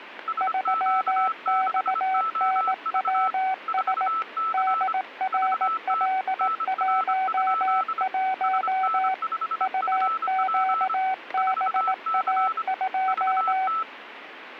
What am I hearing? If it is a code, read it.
Morse code, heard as two keyed tones, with radio static. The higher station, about 25 wpm, 1320 Hz: SQ6OV 4C VT NR? SN5FP 4C VT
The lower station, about 18 wpm, 760 Hz: 3XNWS DRL11 UQBA2